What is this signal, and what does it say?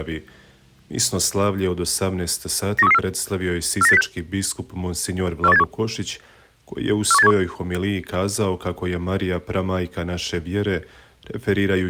Five-tone selective call (EEA), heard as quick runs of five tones, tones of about 40 ms. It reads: 91334 49806 41871 41871